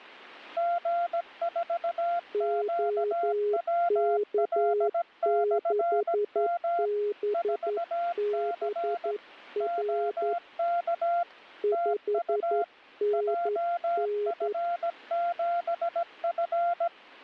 Morse code, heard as two keyed tones. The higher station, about 17 wpm, 690 Hz: G4QWL/M 4C OK TU JF7F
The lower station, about 11 wpm, 410 Hz: OK6BBR 5NN